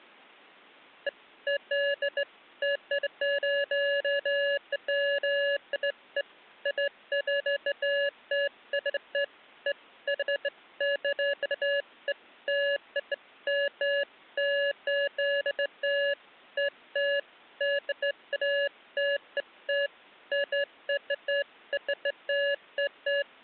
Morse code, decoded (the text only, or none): none